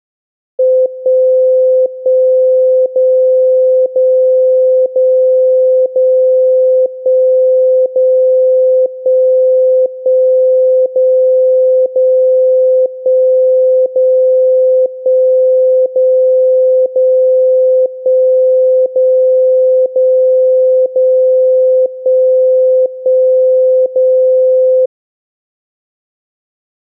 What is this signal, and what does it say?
Radio time signal (DCF77), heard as a tone whose level steps once a second, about 520 Hz. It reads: 1 1 0 0 0 0 1 0 1 1 0 0 1 0 1 0 0 1 0 0 0 1 1 0